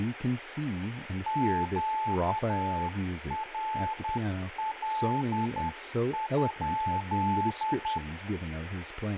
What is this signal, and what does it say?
Morse code, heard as a keyed tone, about 10 wpm, 870 Hz, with radio static and speech in English. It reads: QRL?